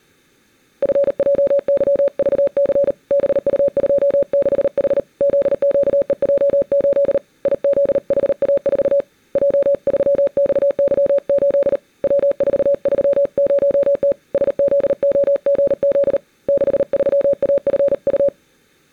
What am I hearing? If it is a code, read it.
Morse code, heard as a keyed tone, hand-sent with a paddle, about 38 wpm, 560 Hz. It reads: FJYVC BU26H ZQEJ8 IZHA4 J3XY8 W430T SZOGZ 63AFU